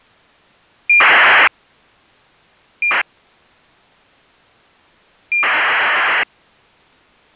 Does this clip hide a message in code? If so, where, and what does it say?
Yes: ACARS aircraft data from 0.9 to 6.2 s, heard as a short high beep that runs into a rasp, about 2400 baud.